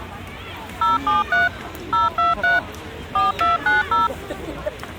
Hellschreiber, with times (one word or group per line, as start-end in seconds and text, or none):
none